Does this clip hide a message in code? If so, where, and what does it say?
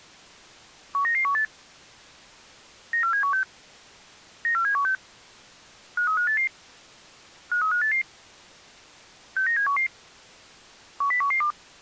Yes: five-tone selective call (CCIR) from 0.9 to 11.5 s, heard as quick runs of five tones, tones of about 100 ms. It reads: 19918 94716 94716 53588 53588 69711 10112